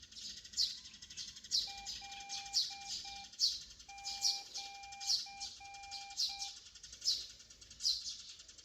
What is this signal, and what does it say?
Morse code (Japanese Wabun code), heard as a keyed tone, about 7 wpm, 800 Hz, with room echo and the noise of a park. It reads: カシ